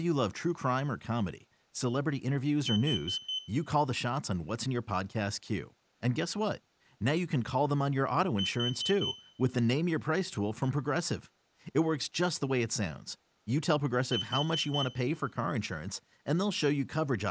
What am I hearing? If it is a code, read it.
Alarm pattern, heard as an alarm's beeps, played three times, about 3050 Hz, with speech in English. Temporal four. Carbon monoxide.